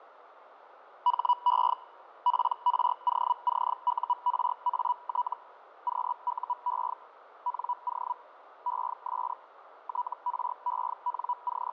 Hellschreiber (Feld-Hell, 122.5 baud), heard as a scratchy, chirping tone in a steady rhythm, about 980 Hz, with radio static, fading and a narrow filter. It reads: HE PROCURAT QUE NO ES …